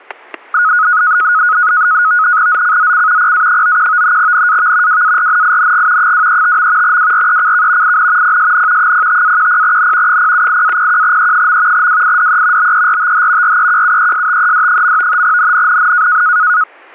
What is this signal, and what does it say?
NAVTEX (SITOR-B), 100 baud, 170 Hz shift, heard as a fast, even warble, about 1360 Hz centre, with static crashes. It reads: ZCZC PA91 NAV WARNING 235. WRECK IN PSN 05-10N 078-01E. WIDE BERTH REQUESTED. NNNN